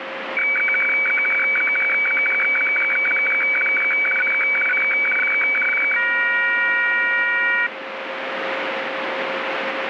Weather fax (radiofax), 120 lines a minute, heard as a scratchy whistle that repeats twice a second, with radio static.